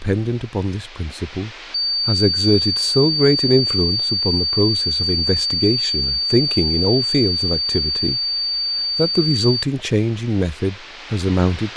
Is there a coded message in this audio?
No, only a steady tone, with speech in English.